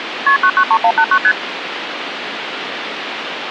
Multi-frequency trunk signalling (R1, as on North American trunks), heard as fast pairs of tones, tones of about 70 ms, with phone line noise. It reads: KP 993189 ST